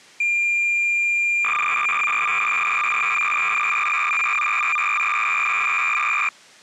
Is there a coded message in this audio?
Yes: cassette data (Kansas City type), 300 baud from 0.2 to 6.3 s, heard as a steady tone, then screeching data.